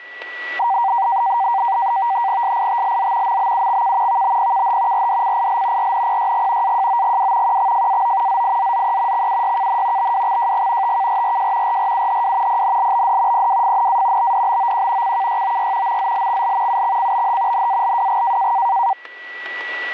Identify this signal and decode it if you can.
NAVTEX (SITOR-B), 100 baud, 170 Hz shift, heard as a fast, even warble, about 860 Hz centre, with static crashes and a steady whistle near 1950 Hz. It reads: SITLZ MBUXK VBPKH RDCIL RNPYG AJOGW QXFAO ZIZZE XUYKN BWXJG TKRRJ RRUHW PNLBD PWFNA BDBOQ CKYOY MZLXL UXCBH NALWG